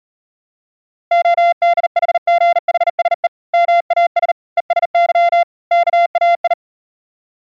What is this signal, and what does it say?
Morse code (Greek alphabet), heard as a keyed tone, hand-sent with a bug key, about 39 wpm, 690 Hz. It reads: ΟΔΗΓΗΣΕ ΜΑΣ ΕΣΥ ΚΑΙ